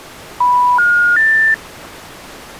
Telephone call progress tone (North American plan), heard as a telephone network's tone, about 980, 1430, 1800 Hz. Special information tone.